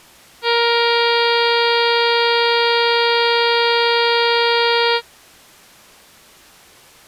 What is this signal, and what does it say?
Ship horn signal, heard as a ship's horn, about 470 Hz. 1 long. At sea: a vessel nearing a blind bend, or under power and making way in fog.